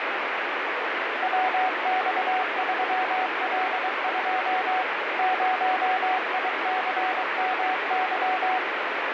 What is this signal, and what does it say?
Morse code, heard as a keyed tone, machine-sent, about 23 wpm, 750 Hz, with heavy radio static. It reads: WX3L2 0ICMY